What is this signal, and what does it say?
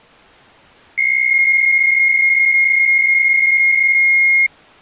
PSK63 (62.5 baud), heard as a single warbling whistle, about 2150 Hz.